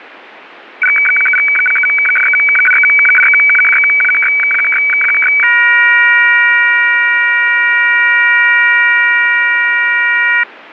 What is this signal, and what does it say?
Weather fax (radiofax), 120 lines a minute, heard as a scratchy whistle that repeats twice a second.